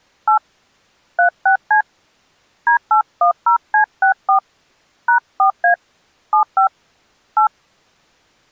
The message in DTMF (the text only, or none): 8 36C D810C64 #4A 75 8